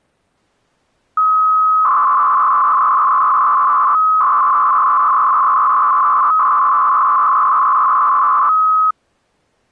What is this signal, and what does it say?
300-baud modem data (Bell 103 tones), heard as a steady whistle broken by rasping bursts, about 300 baud, 200 Hz shift.